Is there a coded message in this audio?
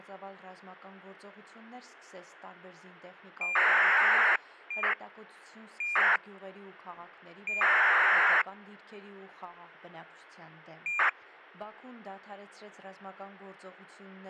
Yes: ACARS aircraft data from 3.4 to 11.1 s, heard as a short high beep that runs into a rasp, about 2400 baud, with a squelch burst at the end.